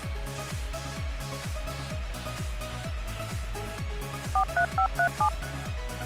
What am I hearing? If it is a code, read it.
DTMF, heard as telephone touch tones, dialled by machine, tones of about 80 ms. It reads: 43537